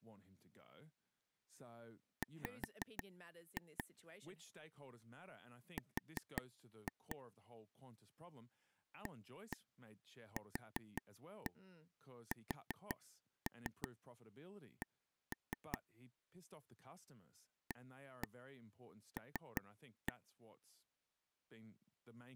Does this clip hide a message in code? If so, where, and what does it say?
Yes: tap code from 2.2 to 20.1 s, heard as taps on a table, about 5 knocks a second, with speech in English. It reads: W R AQSC AL